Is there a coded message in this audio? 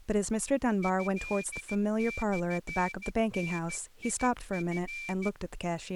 Yes: Morse code (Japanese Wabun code) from 0.8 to 5.3 s, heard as a whistle, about 14 wpm, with speech in English. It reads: トモダチ